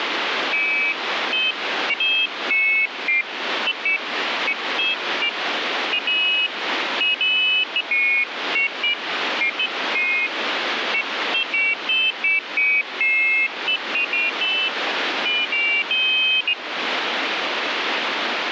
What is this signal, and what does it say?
Pairs of high tones at irregular times, with radio static. There is no code.